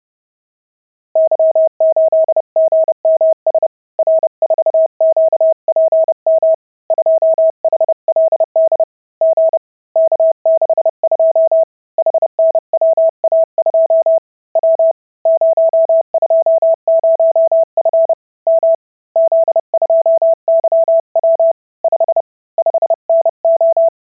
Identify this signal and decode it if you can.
Morse code, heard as a keyed tone, hand-sent with a paddle, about 30 wpm, 650 Hz. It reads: Y8GMS R4QPM 2HLD G K62 HNWA2 W 020F M Z2YW 5 5NO